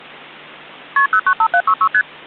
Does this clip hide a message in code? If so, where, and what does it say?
Yes: multi-frequency trunk signalling (R1, as on North American trunks) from 1.0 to 2.0 s, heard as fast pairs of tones, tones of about 70 ms. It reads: KP 095766 ST